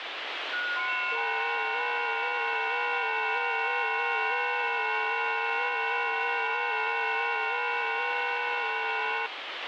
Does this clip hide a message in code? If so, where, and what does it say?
Yes: FT8 (several signals at once) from 0.5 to 9.3 s, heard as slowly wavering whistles, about 6.25 baud, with radio static.